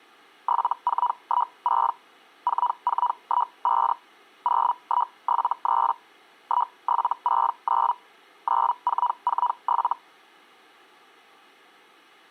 Hellschreiber (Feld-Hell, 122.5 baud), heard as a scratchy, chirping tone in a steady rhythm, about 980 Hz. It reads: 7416 4415 0173 1769 9447